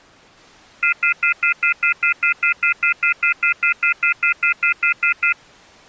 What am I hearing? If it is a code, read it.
Telephone call progress tone (North American plan), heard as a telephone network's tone, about 1400, 2050, 2450, 2600 Hz, 0.1 s on and 0.1 s off. Off-hook warning tone.